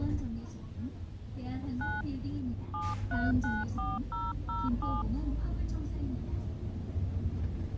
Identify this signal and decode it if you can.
DTMF, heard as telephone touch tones, dialled by hand, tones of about 200 ms, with the noise inside a bus. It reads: 9 7394007